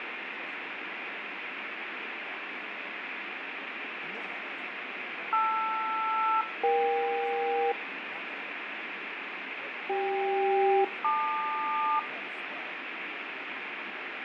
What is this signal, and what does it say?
Aircraft SELCAL, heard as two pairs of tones, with radio static. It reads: LR-EK CK-LQ